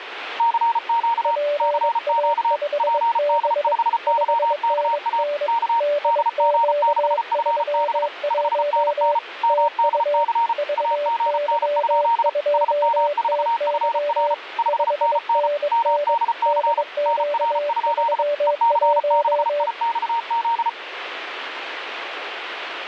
Morse code, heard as two keyed tones, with radio static. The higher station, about 34 wpm, 930 Hz: CQ CQ PD5YKA K DG6FB 5NN MDC AGN? SM4FR 5NN MDC NR? EC6IXZ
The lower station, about 22 wpm, 580 Hz: PA5B 5NN DQ31 TU VY2TY 5NN DQ31